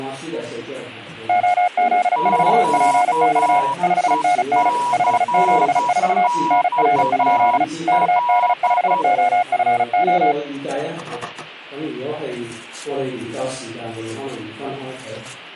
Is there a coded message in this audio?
Yes: Morse code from 1.2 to 10.4 s, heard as two keyed tones. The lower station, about 35 wpm, 720 Hz: OZ4PX 5NN 574 NR? KD5OFO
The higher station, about 10 wpm, 970 Hz: QECXL